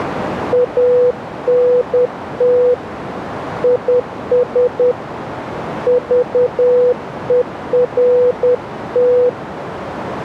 Morse code, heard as a keyed tone, hand-sent with a paddle, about 10 wpm, 490 Hz, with radio static and a narrow filter. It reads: ANT IS VERT